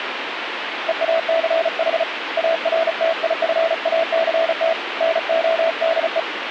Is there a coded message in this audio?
Yes: Morse code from 0.8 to 6.3 s, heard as a keyed tone, hand-sent with a paddle, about 35 wpm, 660 Hz, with radio static. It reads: EACH ARTIFACT NODE